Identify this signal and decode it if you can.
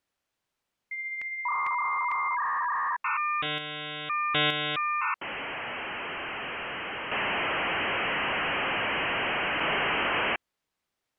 Dial-up modem handshake (V.34 or later), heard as a whistle, warbles, then hiss.